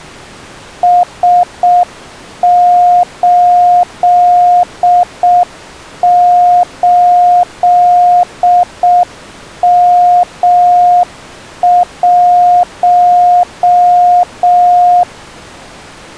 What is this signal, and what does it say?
Morse code, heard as a keyed tone, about 6 wpm, 710 Hz. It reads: S88M1